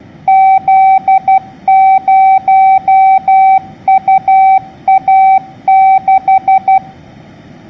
Morse code, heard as a keyed tone, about 12 wpm, 770 Hz. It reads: Z0UA6